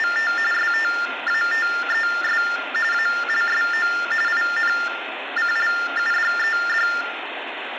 TTY/TDD text telephone tones (45.45 baud Baudot), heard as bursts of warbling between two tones, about 400 Hz shift, 1600 Hz centre, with phone line noise and room echo. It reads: … STATES ALSO INCLUDED